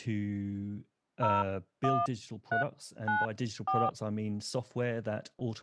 DTMF, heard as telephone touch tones, dialled by hand, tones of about 160 ms, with speech in English. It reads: 01394